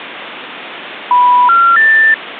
Telephone call progress tone (North American plan), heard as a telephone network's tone, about 980, 1370, 1800 Hz. Special information tone.